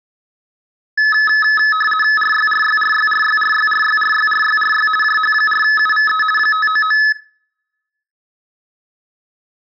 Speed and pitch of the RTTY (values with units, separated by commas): 50 baud, 450 Hz shift, 1500 Hz centre